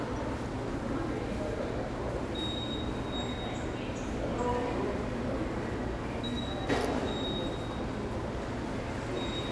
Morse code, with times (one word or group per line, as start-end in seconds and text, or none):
none